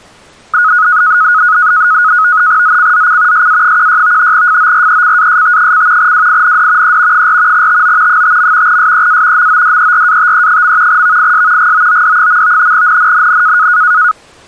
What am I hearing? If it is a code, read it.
NAVTEX (SITOR-B), 100 baud, 170 Hz shift, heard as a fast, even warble, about 1360 Hz centre. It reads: ZCZC SA16 FORECAST: WIND E 4 TO 5. SEA MODERATE. VIS GOOD. NNNN